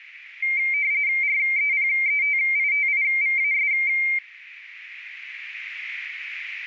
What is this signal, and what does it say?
RTTY (45.45 baud, 170 Hz shift), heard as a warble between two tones, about 2200 Hz centre, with radio static and a narrow filter. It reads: REPETITIVAS